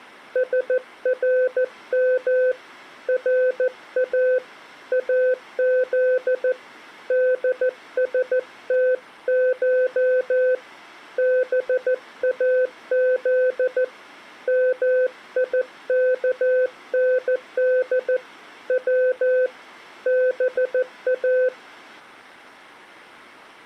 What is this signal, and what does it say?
Morse code (Persian alphabet), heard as a keyed tone, hand-sent with a paddle, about 14 wpm, 510 Hz. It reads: سرم را از دستش باز میکند و با